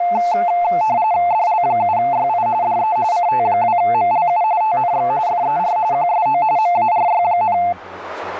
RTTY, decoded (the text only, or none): DL7YI DE CT2MLU TNX FER QSO MARY,